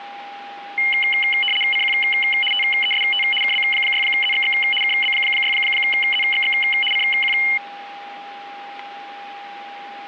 RTTY (75 baud, 850 Hz shift), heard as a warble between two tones, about 2550 Hz centre, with a steady whistle near 810 Hz. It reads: CQ TEST KB6ZXX KB6ZXX CQ